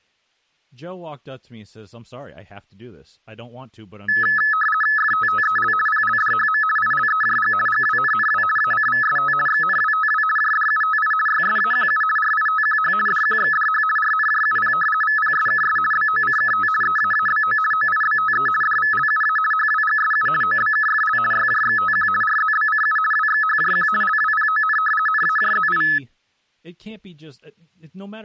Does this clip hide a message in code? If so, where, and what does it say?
Yes: RTTY (50 baud, 450 Hz shift) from 4.1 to 26.0 s, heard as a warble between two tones, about 1500 Hz centre, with speech in English. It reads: FTTEL PLDHM ILEJG GWNNW ACVST XNWTW JDUTI YSAQU RITQH DQXDH RNJUP VPSKS BOCKT EAABO OIBTE DVLUA HWGSU OBKFL YJXTQ RZBCU WXHJQ LWPON NAJZI